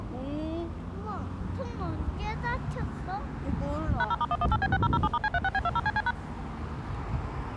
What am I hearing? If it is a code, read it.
DTMF, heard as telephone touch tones, dialled by machine, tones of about 40 ms, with street noise. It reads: #0*118B6007*C36B20CC#